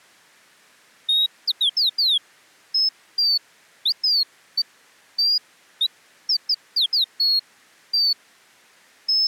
Bird-like chirps. There is no code.